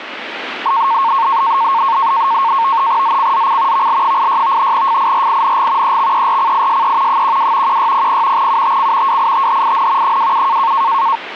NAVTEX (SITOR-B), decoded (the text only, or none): ZCZC VL86 FIRING EXERCISE 12 1600 UTC WITHIN 27